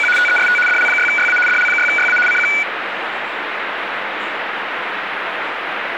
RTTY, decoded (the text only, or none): … TEST DL6YA DL6YA CQ